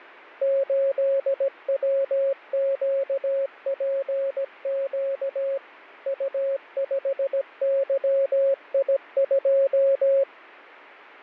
Morse code, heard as a keyed tone, machine-sent, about 17 wpm, 550 Hz. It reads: 8WQPQ U5YI2